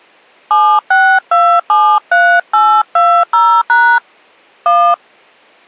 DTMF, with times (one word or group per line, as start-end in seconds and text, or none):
0.5-4.0 76273820#
4.7-4.9 1